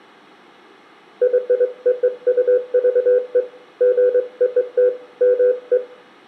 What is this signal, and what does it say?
Morse code (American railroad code), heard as a keyed tone, hand-sent with a straight key, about 500 Hz, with room echo. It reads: YOUVE GOT ME